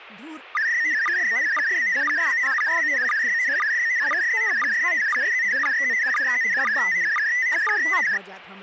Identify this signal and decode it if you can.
SSTV (slow-scan television), PD 120, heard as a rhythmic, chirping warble, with speech in Maithili.